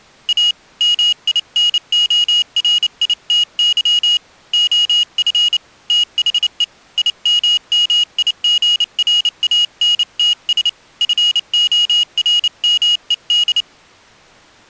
Morse code, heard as a high beeper, hand-sent with a paddle, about 29 wpm, 2900 Hz. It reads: A MINORITY OF THE IMMIGRANTS FORMED